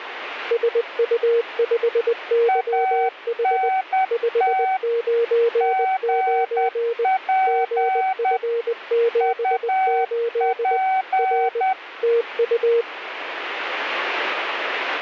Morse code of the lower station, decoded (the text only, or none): SU5YH 599 GF78 R TU